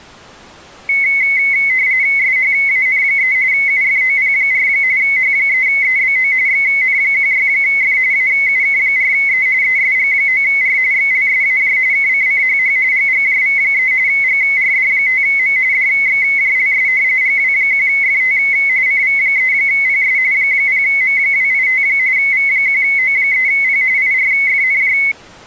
RTTY (45.45 baud, 170 Hz shift), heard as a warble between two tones, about 2150 Hz centre. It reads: SHAN3 UFOP4 H3EBO XN16F AUK4E ESG9R XLSAJ KCCHH GGJV3 GRD5M DXJLS GW1FT CV3PS 0M285 V1O3P IRFNJ